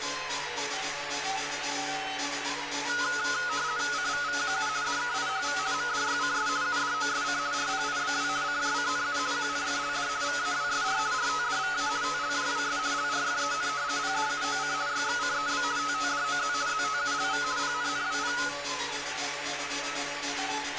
RTTY (50 baud, 170 Hz shift), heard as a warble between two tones, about 1360 Hz centre, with radio static. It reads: CVVQU DKIHV MDYCS UDOSC RPIBW CJCNU QNFLD VAWSR RTDVA TLJWS LRFEN PDUOC YXCEB TTDOZ ZTULV PNNWP